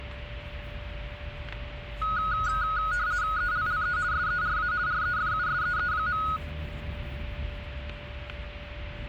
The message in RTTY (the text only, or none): ELLE SERA REFUSEE.